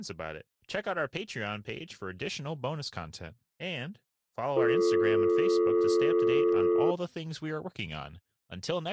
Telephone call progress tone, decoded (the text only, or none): dial tone